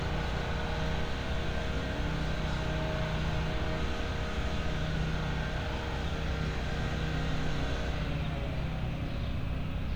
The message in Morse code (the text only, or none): none